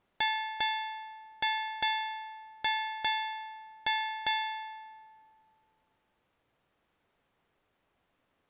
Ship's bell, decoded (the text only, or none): 8